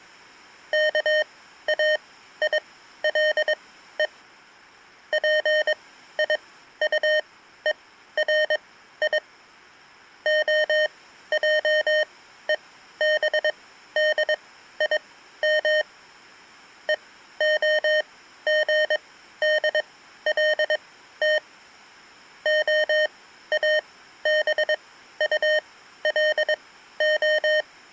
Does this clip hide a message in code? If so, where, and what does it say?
Yes: Morse code (Hebrew alphabet) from 0.7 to 27.7 s, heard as electronic beeps, machine-sent, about 22 wpm, spaced as for 13 wpm, 610 Hz. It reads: כאילו פיטורי העובדים והגדלת האבטלה